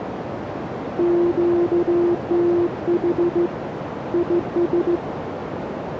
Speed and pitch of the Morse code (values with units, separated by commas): 16 wpm, 350 Hz